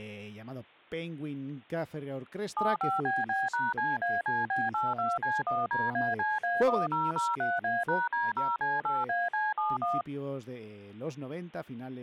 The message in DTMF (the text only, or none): 75BB#CACB82C1DACA1003A#D0C8AC71